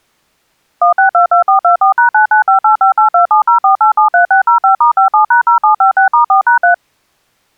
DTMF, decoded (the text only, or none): 1622424#9958582704873605*57#0756*4#3